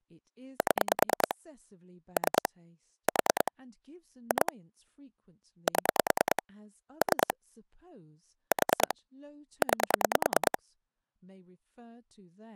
Pulse dialling, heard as clicks on a phone line, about 9 pulses a second, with speech in English. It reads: 7 3 4 2 7 3 4 9